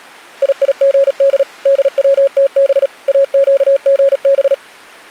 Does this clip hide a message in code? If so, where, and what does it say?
Yes: Morse code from 0.4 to 4.6 s, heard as a keyed tone, machine-sent, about 37 wpm, 550 Hz. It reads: IIGD DWTB AQGB